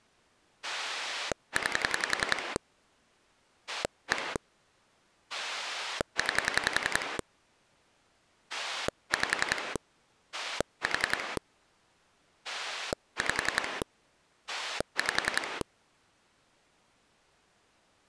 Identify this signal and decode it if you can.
Pulse dialling, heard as a rotary dial, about 10 pulses a second. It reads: 9 1 9 5 4 5 5